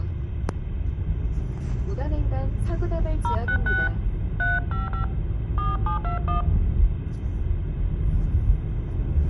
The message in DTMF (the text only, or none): 066 355 4721